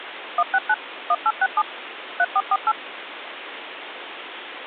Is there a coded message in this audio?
Yes: DTMF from 0.4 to 2.7 s, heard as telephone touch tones, dialled by machine, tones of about 50 ms, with phone line noise. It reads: 169 1867 3448